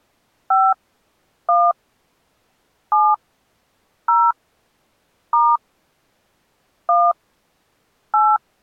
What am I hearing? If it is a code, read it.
DTMF, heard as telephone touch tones, dialled by hand, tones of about 230 ms. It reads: 5 1 7 0 * 1 8